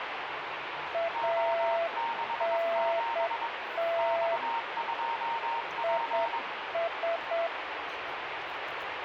Morse code, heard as two keyed tones, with radio static and the noise of a restaurant. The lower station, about 8 wpm, 670 Hz: ANT IS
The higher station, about 22 wpm, 920 Hz: O67 X2P